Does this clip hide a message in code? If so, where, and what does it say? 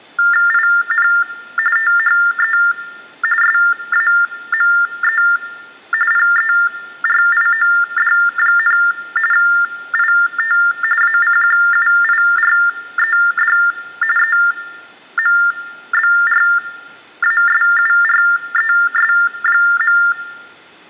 Yes: TTY/TDD text telephone tones (45.45 baud Baudot) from 0.2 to 20.1 s, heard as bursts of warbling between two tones, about 400 Hz shift, 1600 Hz centre, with room echo. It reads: IN THE SAME PERIOD, IT ACQUIRED EMBRASURES.